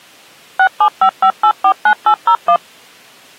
DTMF, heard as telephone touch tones, dialled by machine, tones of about 80 ms. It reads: 6755849801